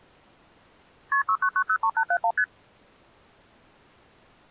Multi-frequency trunk signalling (R1, as on North American trunks), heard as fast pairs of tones, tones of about 70 ms. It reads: KP 69903871 ST